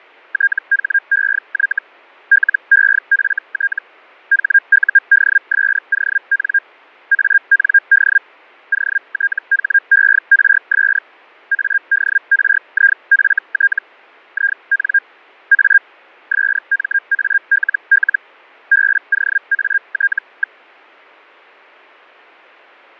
Hellschreiber (Feld-Hell, 122.5 baud), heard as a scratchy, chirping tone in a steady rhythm, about 1600 Hz. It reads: THEY LEFT HUDSON AND OTHERS ADRIFT IN A SMALL BOAT.